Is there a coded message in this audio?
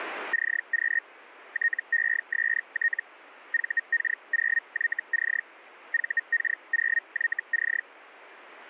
Yes: Hellschreiber (Feld-Hell, 122.5 baud) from 0.3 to 7.8 s, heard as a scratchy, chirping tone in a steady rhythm, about 1850 Hz. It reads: CQ TEST VK0YC VK0YC